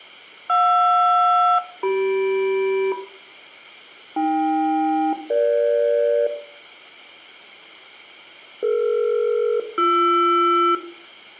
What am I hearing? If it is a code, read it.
Aircraft SELCAL, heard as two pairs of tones, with room echo. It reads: JR-CM AK-EG DE-BR